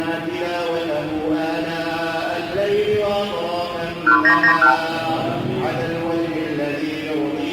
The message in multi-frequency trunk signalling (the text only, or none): 1991